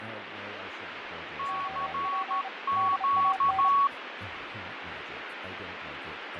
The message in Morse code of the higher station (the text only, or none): CQ